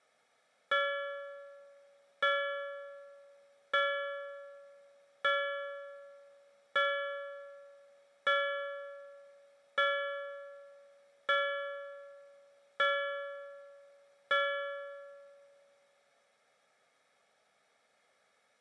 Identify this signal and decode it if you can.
Clock strike, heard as a bell. 10. Ten o'clock.